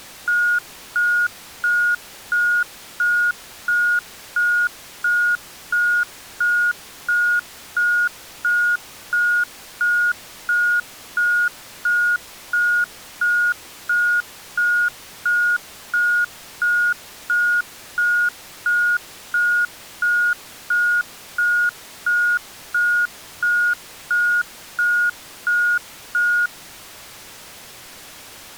Evenly repeated beeps. There is no code.